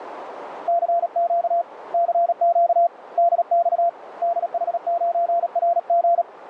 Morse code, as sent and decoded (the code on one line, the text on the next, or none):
-.-. --.- / -.-. --.- / -.. -..- / -.. .... ----. .-. --.
CQ CQ DX DH9RG